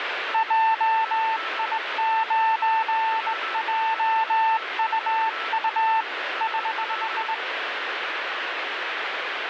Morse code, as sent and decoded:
.--- .. ----. .--- ..- ..- / ........
JI9JUU <HH>

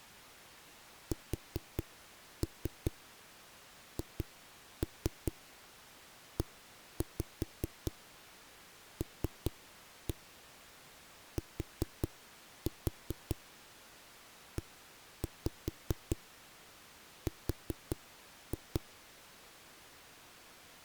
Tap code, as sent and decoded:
4-3 2-3 1-5 3-1 4-4 1-5 4-2
SHELTER

